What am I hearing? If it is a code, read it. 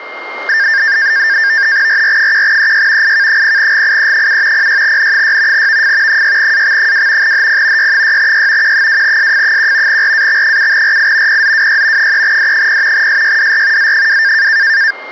NAVTEX (SITOR-B), 100 baud, 170 Hz shift, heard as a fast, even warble, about 1700 Hz centre, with a steady whistle near 2120 Hz. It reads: RR1EY IK0GIE7 06N6 VF 6AX2 HP Y6Y Q2SF1 RAX7RI PZWY 3D0 SYDR Z2